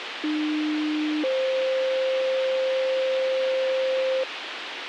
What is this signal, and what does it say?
Two-tone page, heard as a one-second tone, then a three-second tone, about 300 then 520 Hz, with radio hiss.